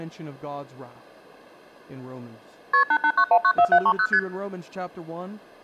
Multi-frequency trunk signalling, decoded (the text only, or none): KP 889194730 ST